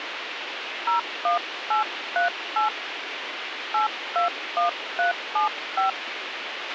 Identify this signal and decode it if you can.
DTMF, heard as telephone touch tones, dialled by hand, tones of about 130 ms, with radio hiss and a squelch burst at the end. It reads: 01838 821375